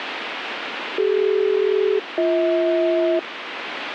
Aircraft SELCAL, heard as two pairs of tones, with radio static. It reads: CD-BH